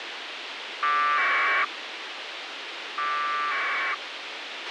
Packet radio (AX.25, as in APRS), 1200 baud, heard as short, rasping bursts, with radio hiss and a squelch burst at the end.